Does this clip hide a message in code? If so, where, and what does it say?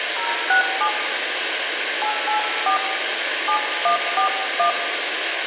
Yes: DTMF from 0.2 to 4.7 s, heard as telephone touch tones, dialled by hand, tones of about 100 ms, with phone line noise and room echo. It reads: 067 884 7141